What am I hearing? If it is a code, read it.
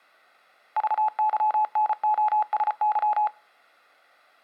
Morse code, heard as a keyed tone, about 34 wpm, 850 Hz. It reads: VYNOSY